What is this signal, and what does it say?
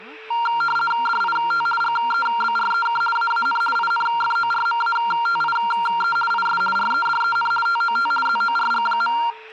RTTY (50 baud, 450 Hz shift), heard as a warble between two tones, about 1160 Hz centre, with static crashes, a steady whistle near 440 Hz and speech in Korean. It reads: DIT GEBREK AAN INFORMATIE IS REDEN TOT ZORG.